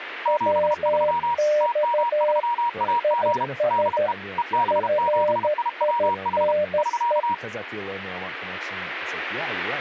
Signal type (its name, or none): Morse code